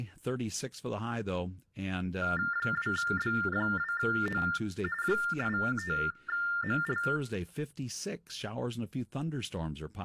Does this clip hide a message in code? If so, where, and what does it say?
Yes: TTY/TDD text telephone tones (45.45 baud Baudot) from 2.2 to 7.2 s, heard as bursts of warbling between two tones, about 400 Hz shift, 1600 Hz centre, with room echo and speech in English. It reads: 2B2O 85ML